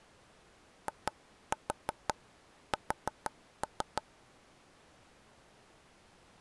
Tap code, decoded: IS

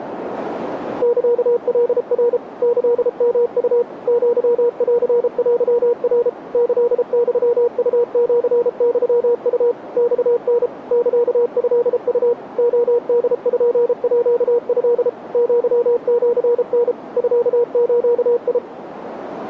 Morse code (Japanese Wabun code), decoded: サカナ キヨウ アンテナ キユウシユウ マタ サトウ レポート アシタ ミズ

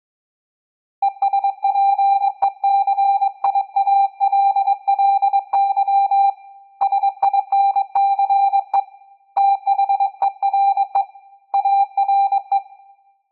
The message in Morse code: ESPECIALLY SINCE THERE ARE

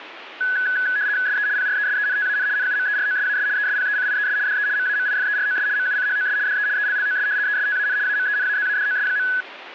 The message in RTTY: SE PRESENTAN NUMEROSAS ESPECIES DE MAMIFEROS MUCHOS DE ELLOS ESTAN AMENAZADOS.

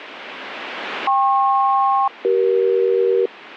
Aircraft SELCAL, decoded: KP-CE

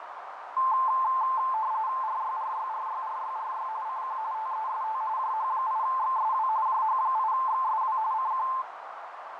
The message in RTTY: RYRYRYRYRY CQ TEST JH8XSW JH8XSW CQ

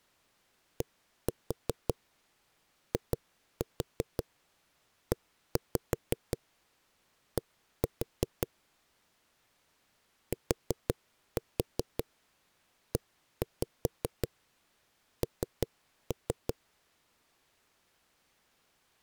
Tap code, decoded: DIED TEN

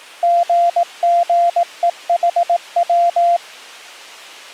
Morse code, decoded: GGEHW

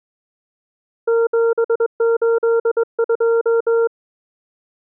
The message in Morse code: 782

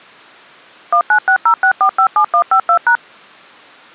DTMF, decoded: 19606457152#

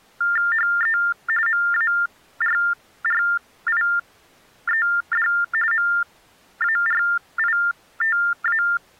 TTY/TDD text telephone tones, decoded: HE MARRIED MARITA

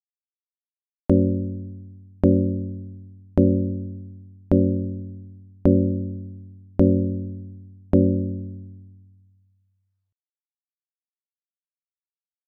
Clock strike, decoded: 7

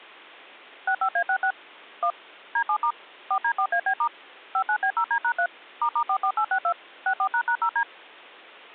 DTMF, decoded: 65A66 1 D7* 4D4AB* 59B0D#3 **44862 64##0D

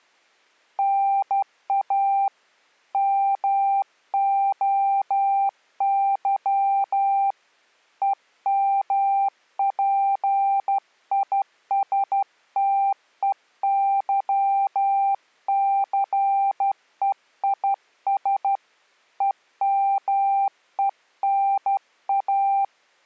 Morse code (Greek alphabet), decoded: ΝΑ ΜΟΥ ΕΜΠΙΣΤΕΥΘΕΙΣ ΕΜΕΝΑ

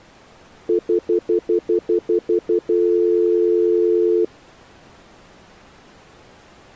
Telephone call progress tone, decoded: stutter dial tone

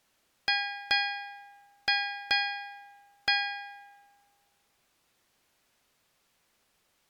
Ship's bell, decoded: 5

